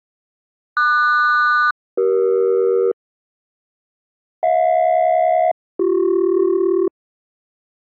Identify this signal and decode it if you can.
Aircraft SELCAL, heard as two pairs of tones. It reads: QS-CE HJ-BC